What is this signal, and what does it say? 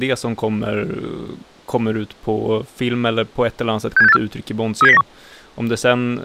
Five-tone selective call (EEA), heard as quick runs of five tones, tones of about 40 ms, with speech in Swedish. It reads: 67684 37091